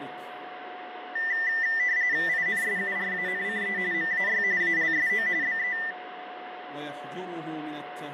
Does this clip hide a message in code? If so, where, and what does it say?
Yes: RTTY (45.45 baud, 170 Hz shift) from 1.2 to 5.9 s, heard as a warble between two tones, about 1900 Hz centre, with radio static and a steady whistle near 730 Hz. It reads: INSURANCE MAY ALSO BE